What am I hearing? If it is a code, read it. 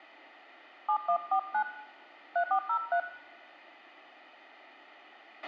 DTMF, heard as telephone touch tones, dialled by hand, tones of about 80 ms, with a squelch burst at the end and room echo. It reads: 7149 3403